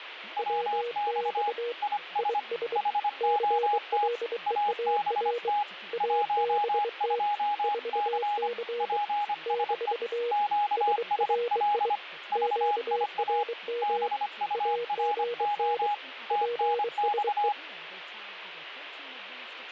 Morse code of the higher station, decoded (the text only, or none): WX IS HOT ABT 12C PSE QSL VIA BURO TNX